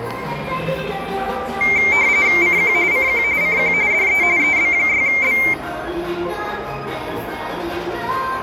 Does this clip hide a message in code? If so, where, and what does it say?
Yes: RTTY (45.45 baud, 170 Hz shift) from 1.6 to 5.5 s, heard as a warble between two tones, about 2200 Hz centre, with the noise of a crowd indoors. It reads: CQ CQ CQ DE EB6B